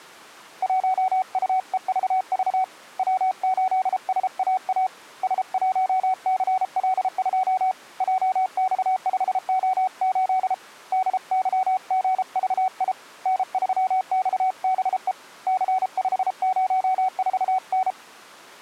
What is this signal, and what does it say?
Morse code, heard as a keyed tone, hand-sent with a paddle, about 33 wpm, 750 Hz. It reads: 1UEVV W8SAA S1CL2 JX5O8 DYGVI N3XBE C504N